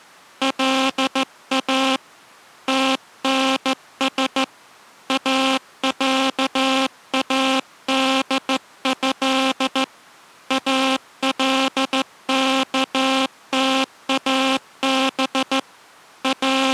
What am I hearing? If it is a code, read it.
Morse code (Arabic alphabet), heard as a buzzer, hand-sent with a straight key, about 14 wpm. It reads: لا تنس اعاده الكتاب …